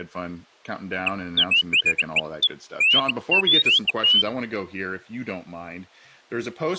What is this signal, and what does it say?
Bird-like chirps, with speech in English. There is no code.